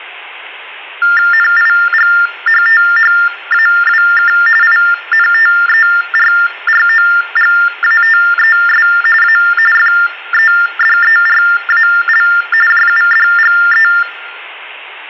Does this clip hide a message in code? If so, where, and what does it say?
Yes: TTY/TDD text telephone tones (45.45 baud Baudot) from 1.0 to 14.0 s, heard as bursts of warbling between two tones, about 400 Hz shift, 1600 Hz centre. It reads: NIGHTHAWK INTERROGATES A FEDERAL JUDGE